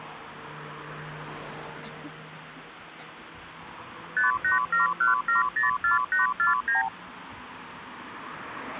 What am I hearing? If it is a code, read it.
Multi-frequency trunk signalling (R2, with the far end's replies), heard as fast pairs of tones, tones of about 140 ms, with phone line noise and street noise. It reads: 5871704849